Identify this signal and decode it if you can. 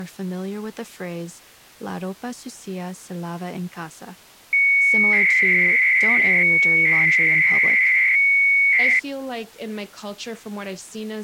300-baud modem data (Bell 103 tones), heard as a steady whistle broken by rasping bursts, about 300 baud, 200 Hz shift, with speech in English.